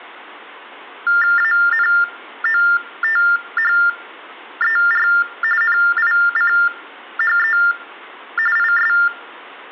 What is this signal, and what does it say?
TTY/TDD text telephone tones (45.45 baud Baudot), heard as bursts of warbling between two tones, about 400 Hz shift, 1600 Hz centre. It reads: ANOTHER NICHE IS